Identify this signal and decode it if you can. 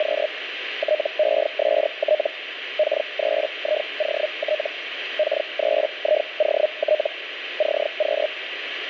Hellschreiber (Feld-Hell, 122.5 baud), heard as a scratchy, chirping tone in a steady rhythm, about 610 Hz, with radio static. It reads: … TEST K3IOT K3IOT CQ